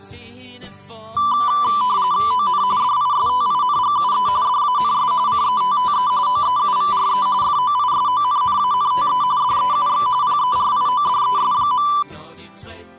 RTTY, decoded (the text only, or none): ON DISTINGUE DANS CETTE OEUVRE FOISONNANTE DEUX PERIODES.